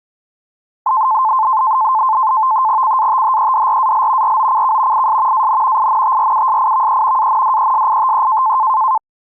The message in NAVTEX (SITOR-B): CATHEDRAL ROCK IS AN INTRUSIVE ANDESITE

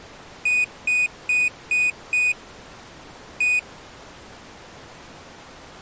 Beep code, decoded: 5-1

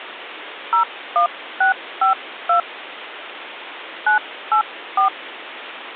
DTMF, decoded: 01652 984

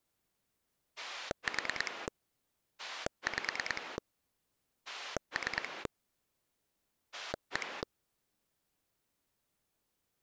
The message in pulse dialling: 4 5 3 1

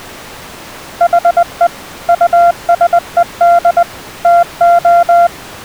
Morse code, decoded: HE USED TO

